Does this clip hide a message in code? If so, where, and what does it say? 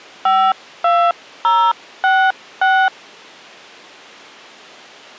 Yes: DTMF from 0.3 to 2.9 s, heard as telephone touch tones, dialled by hand, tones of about 270 ms. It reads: 52066